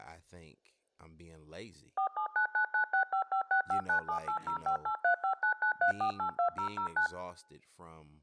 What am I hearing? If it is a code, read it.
DTMF, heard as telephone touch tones, dialled by machine, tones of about 100 ms, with speech in English. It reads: 479996556597805835993482009